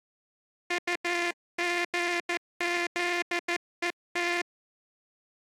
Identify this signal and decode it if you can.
Morse code, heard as a buzzer, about 14 wpm. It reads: UGZET